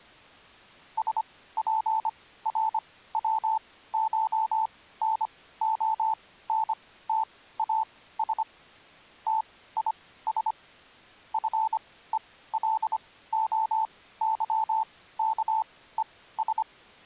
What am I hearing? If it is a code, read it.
Morse code (Greek alphabet), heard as a keyed tone, machine-sent, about 25 wpm, spaced as for 16 wpm, 880 Hz. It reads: ΣΠΡΩΧΝΟΝΤΑΣ ΤΙΣ ΦΕΛΟΥΚΕΣ